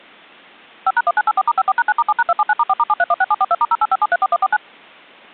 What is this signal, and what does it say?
DTMF, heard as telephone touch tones, dialled by machine, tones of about 40 ms. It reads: 5#1984*54#9*7#279*4*7316742*085734149